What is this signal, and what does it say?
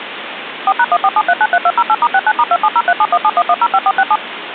DTMF, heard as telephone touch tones, dialled by machine, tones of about 50 ms, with phone line noise. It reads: 4#147393208*69*27037171105467